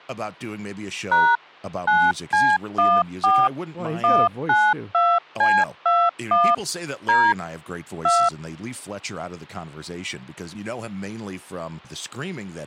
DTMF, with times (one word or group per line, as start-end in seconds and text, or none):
1.1-1.4 #
1.9-3.5 9C14
4.0-6.5 192C21
7.1-7.3 D
8.0-8.3 2